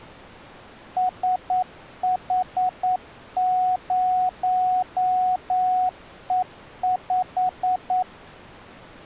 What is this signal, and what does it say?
Morse code, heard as a keyed tone, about 9 wpm, 740 Hz. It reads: SH0E5